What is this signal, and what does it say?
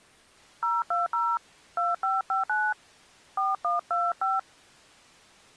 DTMF, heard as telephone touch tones, dialled by hand, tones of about 200 ms. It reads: 020 2559 4125